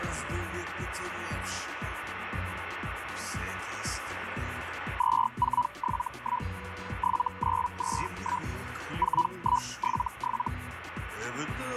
Hellschreiber (Feld-Hell, 122.5 baud), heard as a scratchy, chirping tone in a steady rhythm, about 980 Hz, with radio static and a steady whistle near 1480 Hz. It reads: 2471 7921 4177